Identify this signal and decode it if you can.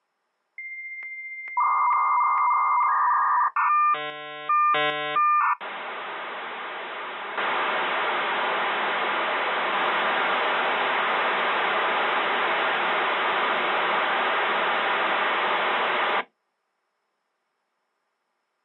Dial-up modem handshake (V.34 or later), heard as a whistle, warbles, then hiss.